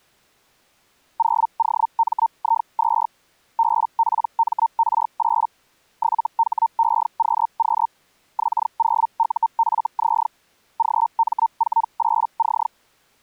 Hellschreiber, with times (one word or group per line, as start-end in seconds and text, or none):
1.2-3.1 0OMI2
3.6-5.5 BPMR8
6.0-7.9 7HEQQ
8.4-10.3 X0UFZ
10.8-12.7 GM48C